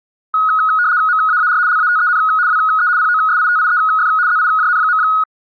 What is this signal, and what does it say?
RTTY (75 baud, 170 Hz shift), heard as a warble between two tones, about 1360 Hz centre. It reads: MAAR LATEN WE POSITIEF ZIJN.